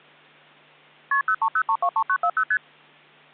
Multi-frequency trunk signalling (R1, as on North American trunks), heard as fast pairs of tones, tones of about 70 ms. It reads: KP 030323940 ST